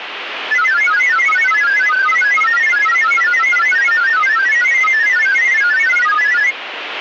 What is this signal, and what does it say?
Multi-tone FSK (Olivia or MFSK type), about 1000 Hz wide, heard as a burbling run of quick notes, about 31.25 baud, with radio static.